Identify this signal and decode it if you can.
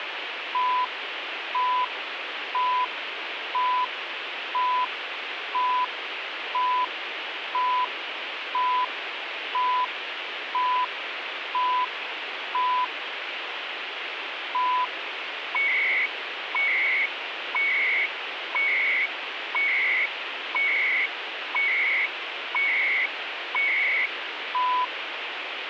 Radio time signal (CHU, Canada), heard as beeps and data bursts, one a second, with radio static.